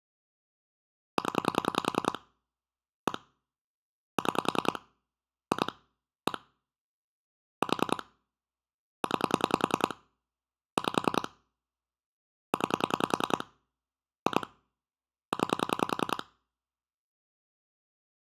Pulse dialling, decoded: 0 1 6 2 1 4 9 5 9 2 9

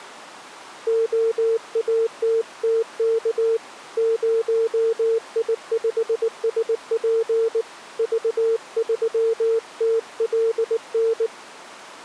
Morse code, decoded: OATTK 0I5SP V3TLN

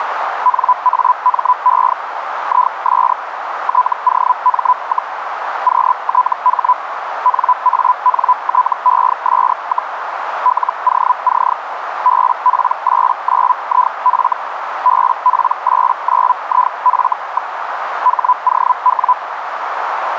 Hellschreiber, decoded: NAME IS TOM, QTH NANTES, LOC BP89IF BP89IF. HOW

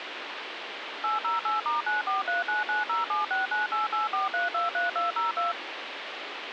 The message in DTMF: 808*943990769884323202

